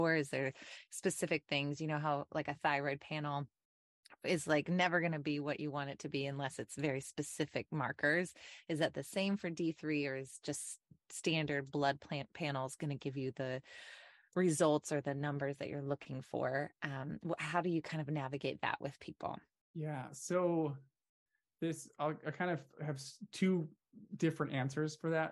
Speech in English. There is no code.